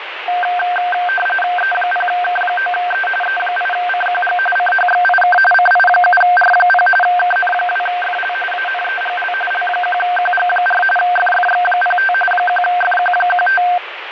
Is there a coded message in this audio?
Yes: RTTY (45.45 baud, 850 Hz shift) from 0.3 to 13.8 s, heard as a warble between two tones, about 1140 Hz centre, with radio static. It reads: E0K9E E8CQG CHXIK CI7R0 KN2FL ANEGL L1QG4 FFX05 1FQ15